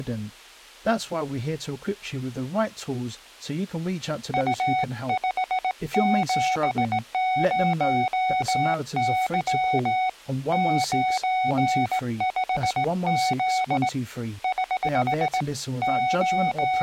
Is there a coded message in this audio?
Yes: Morse code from 4.3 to 16.8 s, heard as a keyed tone, hand-sent with a straight key, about 18 wpm, 740 Hz, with speech in English. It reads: U570Y 95Z <HH> …